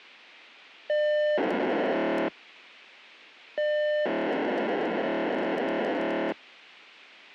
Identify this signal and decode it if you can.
POCSAG pager data (1200 baud), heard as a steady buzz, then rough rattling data.